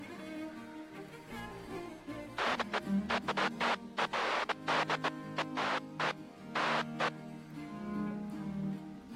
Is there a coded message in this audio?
No, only bursts of noise.